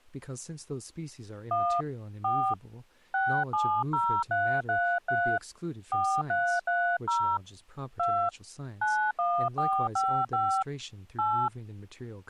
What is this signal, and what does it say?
DTMF, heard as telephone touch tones, dialled by hand, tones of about 300 ms, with speech in English. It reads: 1 4 670333 4330 2 91455 8